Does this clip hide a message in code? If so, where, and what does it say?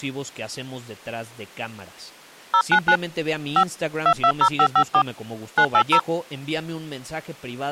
Yes: DTMF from 2.5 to 6.0 s, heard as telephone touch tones, dialled by hand, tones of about 70 ms, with speech in Spanish. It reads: 099 5 220554 980